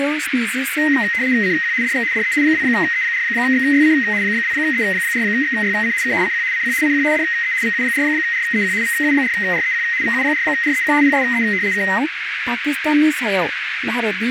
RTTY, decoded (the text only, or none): CQ DX DE 2E4XYC 2E4XYC K CQ CQ CQ DE VU4REQ VU4REQ VU4REQ PSE K